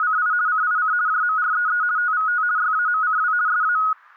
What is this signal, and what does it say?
RTTY (50 baud, 170 Hz shift), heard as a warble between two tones, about 1360 Hz centre, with static crashes. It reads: … CIC JMREE TVT YAMCW SA